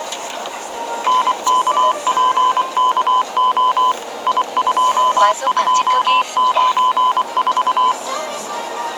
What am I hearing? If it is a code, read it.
Morse code, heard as a keyed tone, machine-sent, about 24 wpm, 1010 Hz, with the noise inside a car. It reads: NKPKO I2294